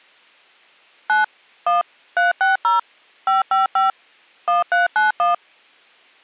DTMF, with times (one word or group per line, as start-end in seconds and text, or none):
1.1-1.2 9
1.7-1.8 1
2.2-2.8 360
3.3-3.9 555
4.5-5.3 1391